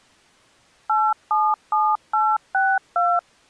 DTMF, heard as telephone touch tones, dialled by machine, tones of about 230 ms. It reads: 877862